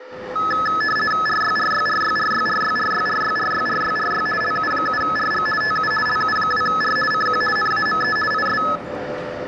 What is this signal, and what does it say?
RTTY (50 baud, 450 Hz shift), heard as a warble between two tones, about 1500 Hz centre, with radio static, a steady whistle near 510 Hz and the noise of a crowd indoors. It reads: RYRYRYRYRYRYRYRYRYRY LU7RG TU LU2R CQ NAME IS